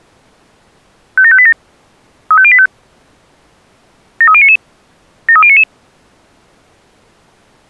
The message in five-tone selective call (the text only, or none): 57587 35085 73099 73099